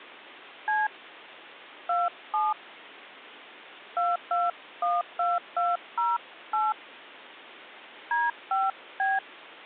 DTMF, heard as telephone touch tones, dialled by hand, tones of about 190 ms. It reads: C 27 2212208 D5B